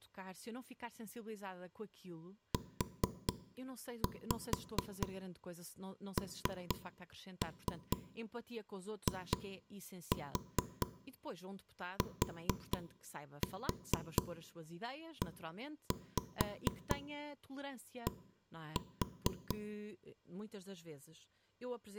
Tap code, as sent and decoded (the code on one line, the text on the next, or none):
4-5 3-3 2-4 4-4 1-5 1-4
UNITED